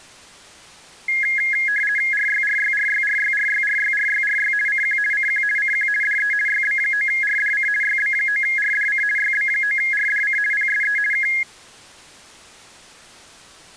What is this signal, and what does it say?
RTTY (50 baud, 450 Hz shift), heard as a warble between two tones, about 1900 Hz centre. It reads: RYRYRYRYRYRYRYRY CQ CQ CQ DE YB9RDC YB9RDC YB9RDC PSE K